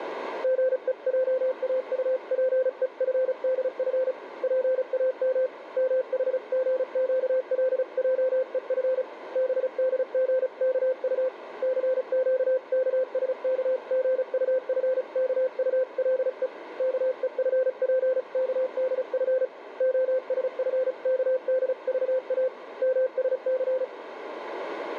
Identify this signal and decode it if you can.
Morse code (Korean alphabet), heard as a keyed tone, hand-sent with a paddle, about 35 wpm, 520 Hz, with radio static and a narrow filter. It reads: 사회자는 좀 무색한 듯이 채영신이가 앉은 편으로 몇